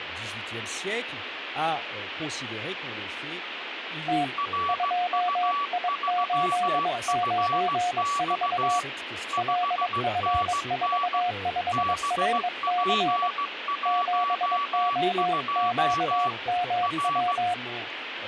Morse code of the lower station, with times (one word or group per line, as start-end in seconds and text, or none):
4.1-4.2 T
4.7-8.8 2I894
9.4-13.3 LF45RC
13.9-17.5 7OQMW